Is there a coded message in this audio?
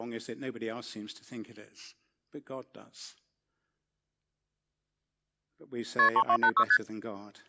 Yes: multi-frequency trunk signalling (R1, as on North American trunks) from 6.0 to 6.8 s, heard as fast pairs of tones, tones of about 70 ms, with speech in English. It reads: KP 3286 ST